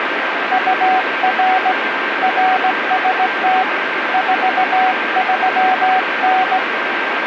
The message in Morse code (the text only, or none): UR RST 43N